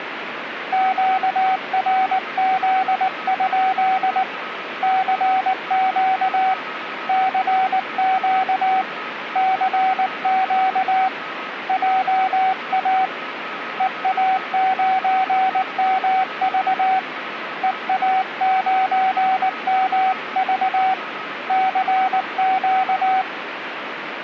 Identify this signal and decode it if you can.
Morse code, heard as a keyed tone, hand-sent with a paddle, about 19 wpm, 760 Hz, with radio static and a weaker station near 1280 Hz. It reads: QRZ? CQ CQ CQ JA EA9MV EA9MV CQ